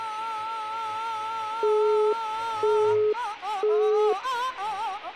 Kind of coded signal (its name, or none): telephone call progress tone